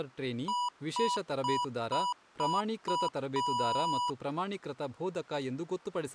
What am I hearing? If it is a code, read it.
Beep code, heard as beeps from a small speaker, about 980 Hz, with speech in Kannada. 6 short, 1 long.